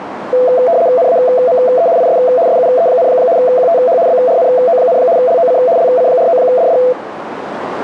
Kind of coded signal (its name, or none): RTTY